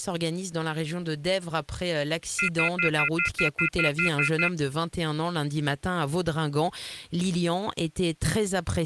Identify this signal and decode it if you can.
Telephone call progress tone (North American plan), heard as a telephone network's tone, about 1400, 2050, 2450, 2600 Hz, 0.1 s on and 0.1 s off. Off-hook warning tone.